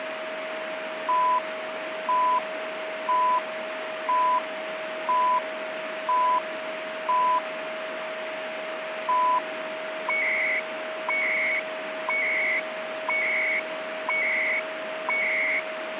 Radio time signal (CHU, Canada), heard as beeps and data bursts, one a second, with radio static and a steady whistle near 630 Hz.